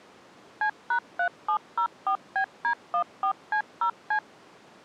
DTMF, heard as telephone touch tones, dialled by machine, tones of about 90 ms. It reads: C#3704BD14C0C